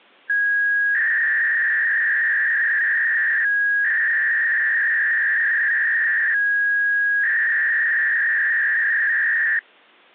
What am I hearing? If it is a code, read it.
300-baud modem data (V.21 tones), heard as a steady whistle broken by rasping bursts, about 300 baud, 200 Hz shift.